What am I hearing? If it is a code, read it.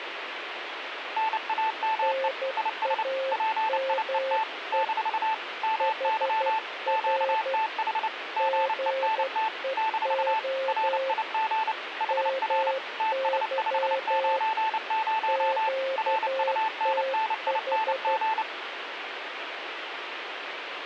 Morse code, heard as two keyed tones, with radio static. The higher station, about 29 wpm, 880 Hz: NAME IS PIET - MY QTH GENT - RIG HR TS590 RUNNING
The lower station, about 12 wpm, 530 Hz: NAME HR GEO MY QTH